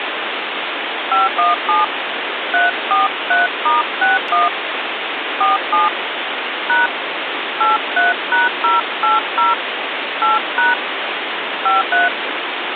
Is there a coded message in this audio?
Yes: DTMF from 1.1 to 12.1 s, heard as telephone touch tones, dialled by hand, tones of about 160 ms, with phone line noise. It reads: 517 343*61 47 # 83#080 8# 53